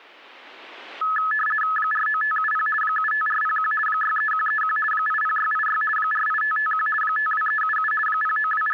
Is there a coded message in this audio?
Yes: RTTY (50 baud, 450 Hz shift) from 1.0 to 8.7 s, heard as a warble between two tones, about 1500 Hz centre. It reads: 49570 75401 63131 80686 48551 52377 …